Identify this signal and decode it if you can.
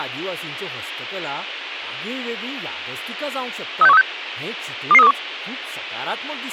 Five-tone selective call (EEA), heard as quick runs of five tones, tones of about 40 ms, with speech in Goan Konkani. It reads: 36136 22321